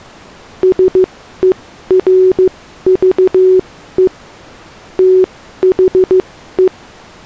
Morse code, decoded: SERVE THE

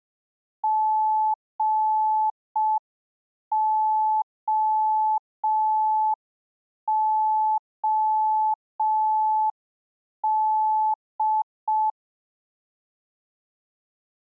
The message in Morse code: GOOD

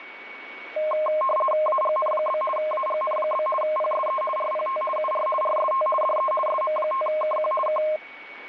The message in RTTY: AGN? AGN? PSE RPT UR RST DE SM5KQ K

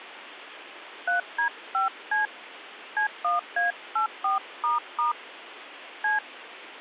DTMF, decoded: 3D5C C1A84** C

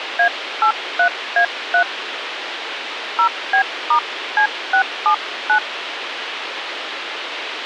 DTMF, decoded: A83A3 0B*C679

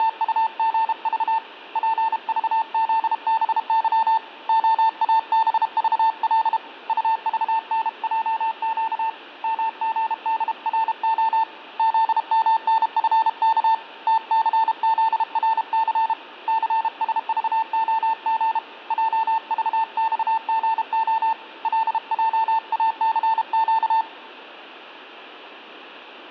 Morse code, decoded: … PVZBY OABVL UVNJQ MGDRO ZMNFK TCZRC CSVOG JVXGO LJACQ

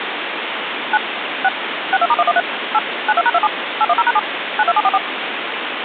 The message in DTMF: 9 6 62*113 8 92#27 810#7 92744

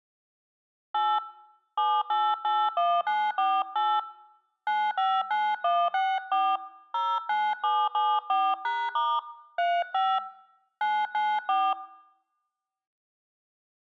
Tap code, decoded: none

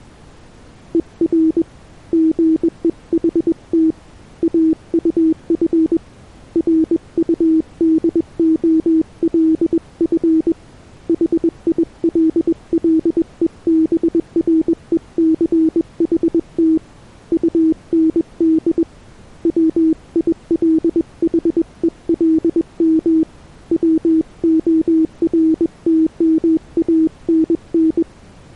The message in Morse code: ER GEHT AUF RUDOLF HILLEBRECHT UND WILHELM WORTMANN

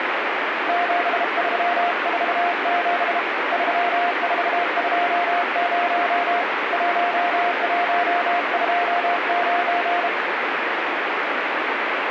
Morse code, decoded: 7347 3420 1129

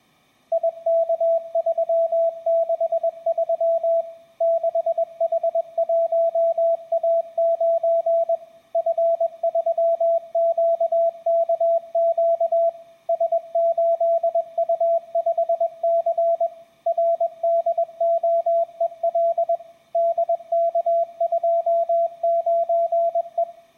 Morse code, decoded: IK363 6H1A9 F3QKQ S8U5C RDOEL DK29E

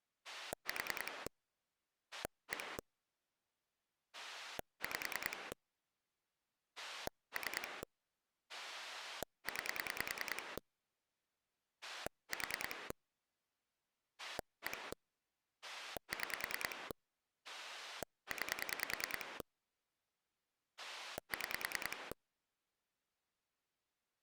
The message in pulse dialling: 4 1 5 3 9 4 1 6 9 6

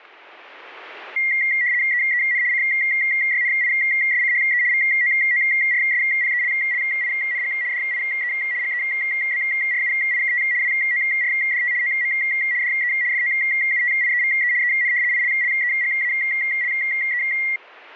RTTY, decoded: EEN CYNISCHE VOORSPELLING DIE GEBRUIKT WORDT OM DE FOUTIEVE EN ILLEGALE

